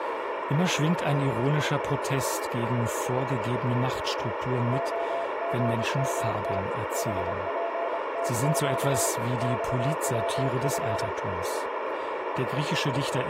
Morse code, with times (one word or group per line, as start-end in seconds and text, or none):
4.7-6.6 OGMT
7.0-9.1 HPTQ
9.4-11.1 XWF